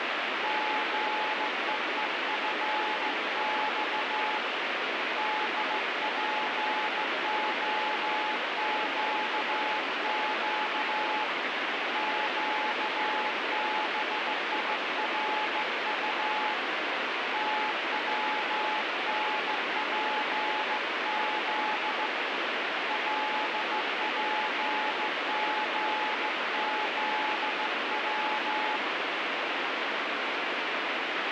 Morse code, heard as a keyed tone, hand-sent with a straight key, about 15 wpm, 860 Hz, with heavy radio static. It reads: GEEFX DPOQQ QBIRU TWNPZ LPGZW